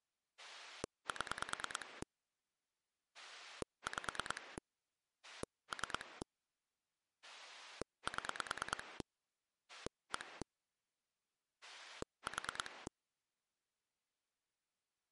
Pulse dialling, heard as a rotary dial, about 9 pulses a second. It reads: 7 5 3 7 1 4